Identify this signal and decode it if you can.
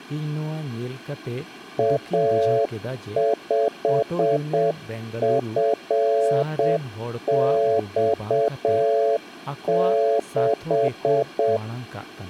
Morse code, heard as a keyed tone, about 7 wpm, 560 Hz, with room echo and speech in Santali. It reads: A5FX6